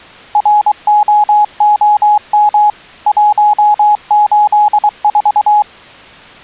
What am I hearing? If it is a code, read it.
Morse code, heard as a keyed tone, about 23 wpm, 840 Hz. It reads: ROOM 184